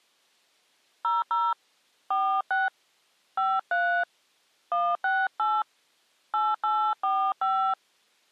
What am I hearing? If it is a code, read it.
DTMF, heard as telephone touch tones, dialled by hand, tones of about 250 ms. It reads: 00 46 53 168 8845